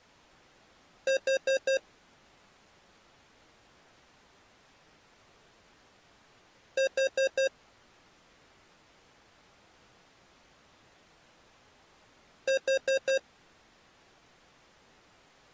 Alarm pattern, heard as an alarm's beeps, played three times, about 540 Hz. Temporal four. Carbon monoxide.